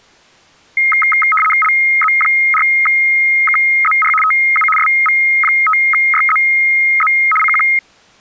RTTY (75 baud, 850 Hz shift), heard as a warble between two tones, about 1700 Hz centre. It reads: LZ4KZR TU SV5YZZ CQ